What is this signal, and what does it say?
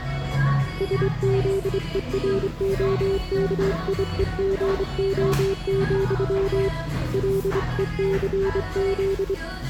Morse code, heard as a keyed tone, hand-sent with a straight key, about 25 wpm, 390 Hz, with the noise of a cafe. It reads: SZEROKIEGO, LECZ